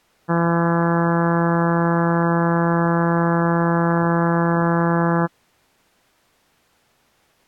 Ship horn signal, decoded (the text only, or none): 1 long